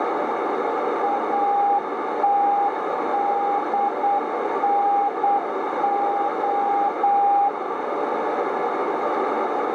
Morse code, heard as a keyed tone, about 8 wpm, 810 Hz, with heavy radio static and a narrow filter. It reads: ATDNO